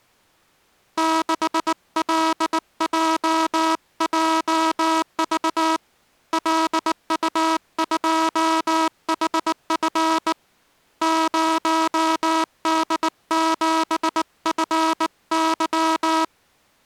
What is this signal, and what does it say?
Morse code, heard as a buzzer, hand-sent with a bug key, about 19 wpm. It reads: 6LJJV LU2HF 0D7FY